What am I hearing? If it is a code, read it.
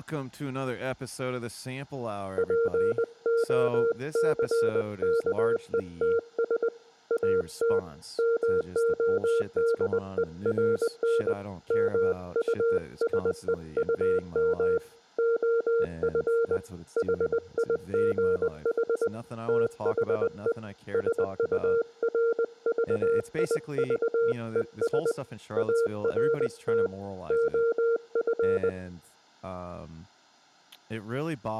Morse code, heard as a keyed tone, hand-sent with a paddle, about 20 wpm, 460 Hz, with speech in English. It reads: POCKETS AT MODERN MUSEUM OF HIGH THE SURVIVES ART OF